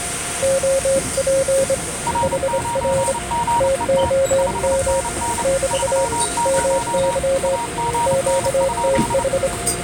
Morse code, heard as two keyed tones, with the noise inside a subway train. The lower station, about 26 wpm, 540 Hz: OP HR TOM <BT> MY QTH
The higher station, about 29 wpm, 940 Hz: R9GET 5NN 30 AGN?